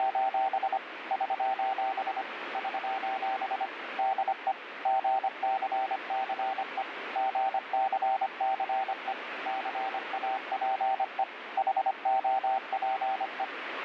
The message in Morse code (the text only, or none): … <SOS> <SOS> DE GCCE GCCE CAPE HOPE